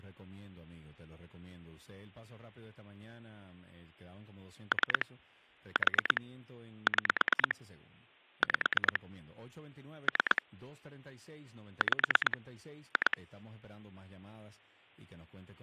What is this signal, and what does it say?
Pulse dialling, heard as clicks on a phone line, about 9 pulses a second, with speech in Spanish. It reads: 3 4 6 5 3 5 2